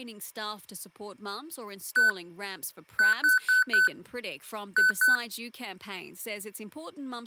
Beep code, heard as beeps from a small speaker, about 1500 Hz, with speech in English. 1-4-2. In Phoenix BIOS tables: parity failure in the first 64 KB of memory.